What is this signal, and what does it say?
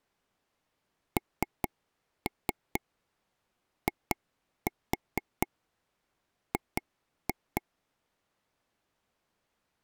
Tap code, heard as taps on a table, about 4 knocks a second. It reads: NIG